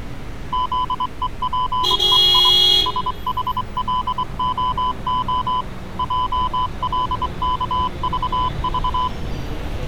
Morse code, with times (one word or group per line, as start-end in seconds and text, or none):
0.5-2.5 ZEPEI
2.9-5.6 SHLOO
6.0-9.1 JLKVV